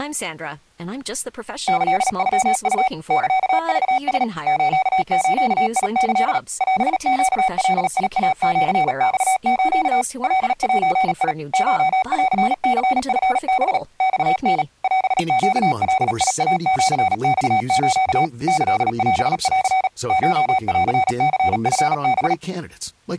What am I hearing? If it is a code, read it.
Morse code (Japanese Wabun code), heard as electronic beeps, machine-sent, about 37 wpm, 760 Hz, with speech in English. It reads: キノウ サクラ スズキ オネガイシマス カゼ コンニチハ マタ オネガイシマス キオン コンニチハ